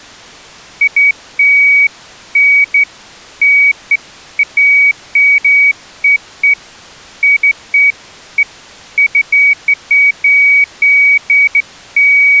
Beeps of irregular length. There is no code.